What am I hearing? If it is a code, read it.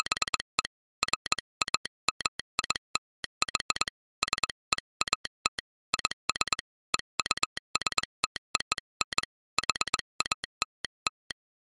Morse code (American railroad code), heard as a telegraph sounder, hand-sent with a straight key. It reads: … FAMILY SEAT IS EUSTON HALL